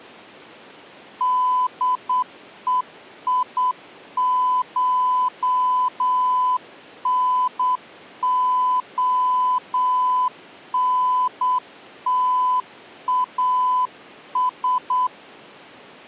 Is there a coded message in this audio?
Yes: Morse code (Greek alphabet) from 1.1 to 15.1 s, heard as a keyed tone, hand-sent with a straight key, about 8 wpm, 1000 Hz. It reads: ΔΕΙΧΝΟΝΤΑΣ